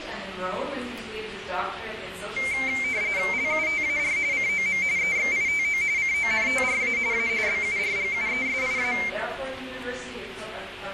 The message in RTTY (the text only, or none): LUTAR COM EXITO CONTRA A BURGUESIA